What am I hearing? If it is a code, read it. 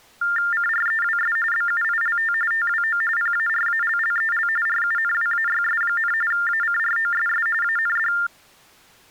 TTY/TDD text telephone tones (45.45 baud Baudot), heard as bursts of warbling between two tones, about 400 Hz shift, 1600 Hz centre. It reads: CREWS BUILT TWO PARALLEL RUNWAYS, ACROSS AND